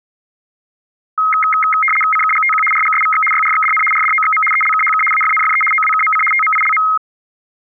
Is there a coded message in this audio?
Yes: RTTY (75 baud, 850 Hz shift) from 1.2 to 7.0 s, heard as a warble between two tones, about 1700 Hz centre. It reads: CKGTQ RGSVX YRXDN RDOXM ELKHK AFNFE OWKMC TMILM